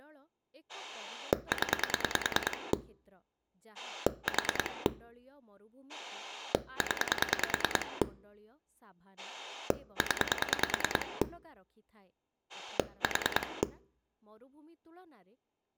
Pulse dialling, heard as a rotary dial, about 10 pulses a second, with speech in Odia. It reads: 0 4 0 0 4